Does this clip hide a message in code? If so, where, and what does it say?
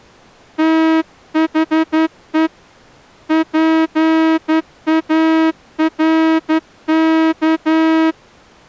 Yes: Morse code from 0.5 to 8.2 s, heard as a horn, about 11 wpm. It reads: THE PARK